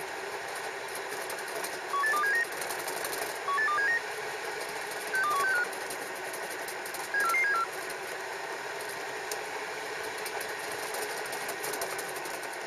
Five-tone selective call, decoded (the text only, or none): 18279 18279 62165 74474